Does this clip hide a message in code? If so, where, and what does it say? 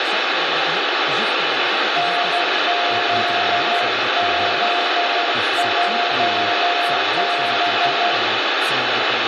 Yes: Morse code (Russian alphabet) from 1.9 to 8.2 s, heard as a keyed tone, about 12 wpm, 700 Hz, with heavy radio static, room echo and speech in French. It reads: НЗЗЙБ